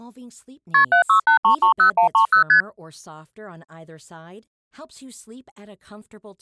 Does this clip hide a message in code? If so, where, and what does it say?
Yes: multi-frequency trunk signalling (R1, as on North American trunks) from 0.7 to 2.6 s, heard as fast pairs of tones, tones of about 100 ms, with speech in Swedish. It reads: KP 768330130 ST